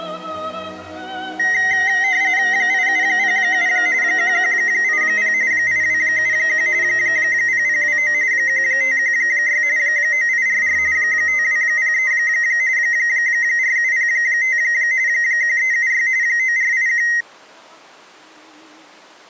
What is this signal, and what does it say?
RTTY (45.45 baud, 170 Hz shift), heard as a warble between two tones, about 1950 Hz centre. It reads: 8707 1180 8271 0029 1516 9844 5203 4705 1376 9481